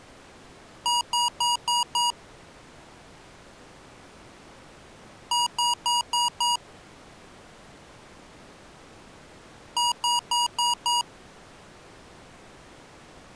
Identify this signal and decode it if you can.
Beep code, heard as beeps from a small speaker, played three times, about 960 Hz. 5 short. In AMI BIOS tables: processor failure; in Dell tables: CMOS battery failure.